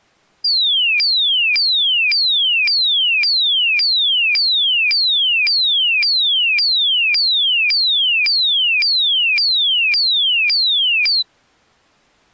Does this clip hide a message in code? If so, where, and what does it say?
No, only a tone that sweeps in pitch again and again.